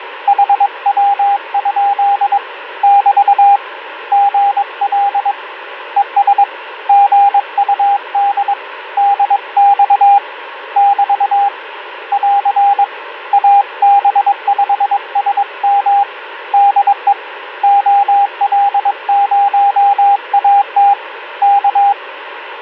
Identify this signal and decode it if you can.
Morse code, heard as a keyed tone, hand-sent with a paddle, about 22 wpm, 800 Hz, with radio static. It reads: HW? <BT> GL ES GUD DX <BT> <AR> AB5SM DE OL0AT K